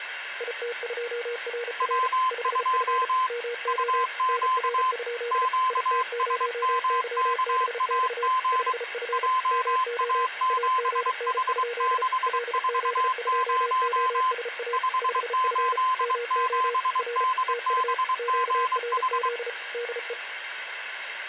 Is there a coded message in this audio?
Yes: Morse code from 0.3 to 20.2 s, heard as two keyed tones, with radio static. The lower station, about 34 wpm, 480 Hz: IT2RR 5F MO NR? IT0YBX 5F MO AGN? LZ2OSA 5F MO R TU QRZ DE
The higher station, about 23 wpm, 1030 Hz: W2 UQ QSMKAG JA7H640 587DBGH